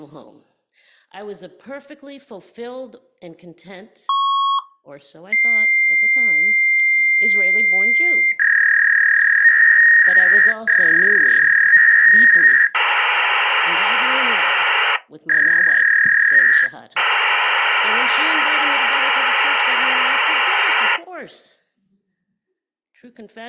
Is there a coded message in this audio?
Yes: fax machine handshake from 4.1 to 21.0 s, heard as a beep, a long tone, a warble and hiss.